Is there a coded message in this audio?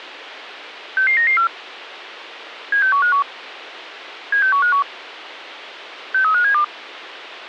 Yes: five-tone selective call (CCIR) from 1.0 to 6.6 s, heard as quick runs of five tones, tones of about 100 ms, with a squelch burst at the end. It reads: 66994 76151 76151 63572